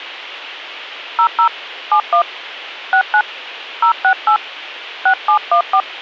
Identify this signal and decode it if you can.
DTMF, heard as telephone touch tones, dialled by hand, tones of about 90 ms. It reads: 00 71 69 068 6714